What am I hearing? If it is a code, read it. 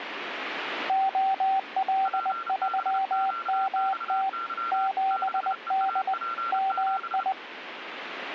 Morse code, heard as two keyed tones, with radio static. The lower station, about 20 wpm, 770 Hz: OL3MT 7D MI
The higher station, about 31 wpm, 1360 Hz: PBQXY 6EAP7